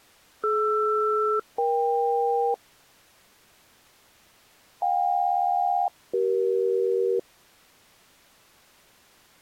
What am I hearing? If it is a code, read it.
Aircraft SELCAL, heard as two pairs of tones. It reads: DR-EK JK-CE